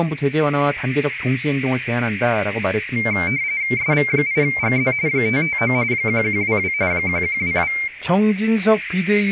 RTTY (45.45 baud, 170 Hz shift), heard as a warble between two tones, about 2200 Hz centre, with radio static and speech in Korean. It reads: SV8GZ 559 1122 1122